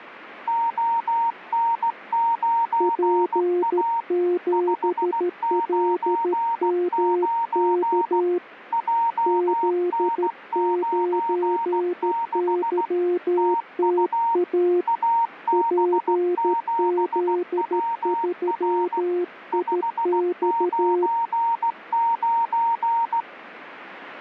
Morse code, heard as two keyed tones. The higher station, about 16 wpm, 920 Hz: ON9A 599 JN96 TU AB7WR 599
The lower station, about 13 wpm, 350 Hz: P7LMK Z9YTA PZ3IX